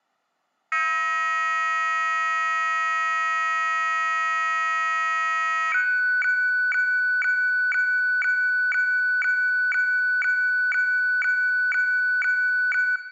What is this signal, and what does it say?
Weather fax (radiofax), 120 lines a minute, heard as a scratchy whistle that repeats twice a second, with room echo.